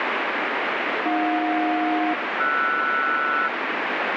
Aircraft SELCAL, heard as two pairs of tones, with heavy radio static. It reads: AJ-RS